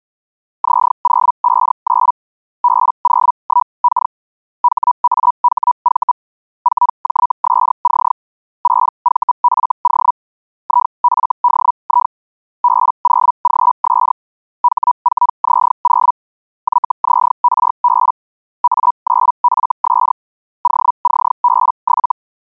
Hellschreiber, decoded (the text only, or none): Z059 B01K HAHV 4JSC 6VFO IFDI B0GS H4Z0 YZRB A9FS OCB7